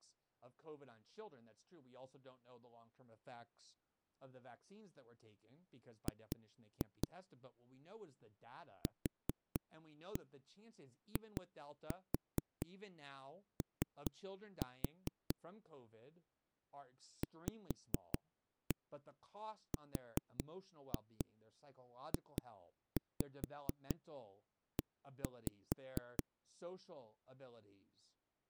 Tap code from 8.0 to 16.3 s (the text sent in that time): QIO